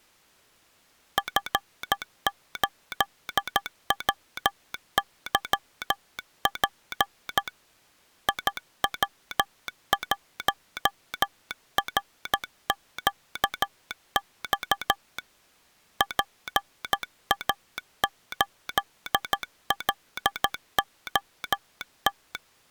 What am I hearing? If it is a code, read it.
Morse code, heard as a telegraph sounder, hand-sent with a paddle, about 13 wpm. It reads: F8WYP IW1RQX PA8LOT